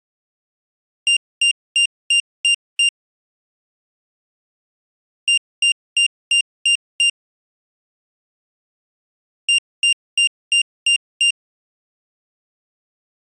Beep code, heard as a piezo beeper, played three times, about 2800 Hz. 6 short. In AMI BIOS tables: keyboard controller gate A20 failure; in Dell tables: video card failure.